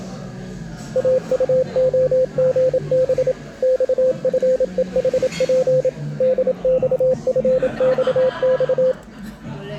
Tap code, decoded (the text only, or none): none